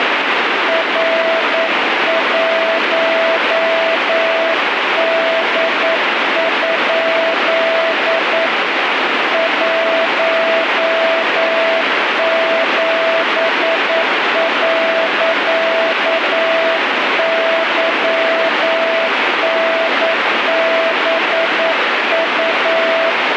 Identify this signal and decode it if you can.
Morse code, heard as a keyed tone, hand-sent with a paddle, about 9 wpm, 660 Hz, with heavy radio static. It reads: R1D? 17.YNBU